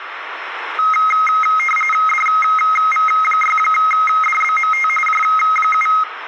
RTTY (45.45 baud, 850 Hz shift), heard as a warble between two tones, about 1700 Hz centre, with radio static and room echo. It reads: DV6DBMT J7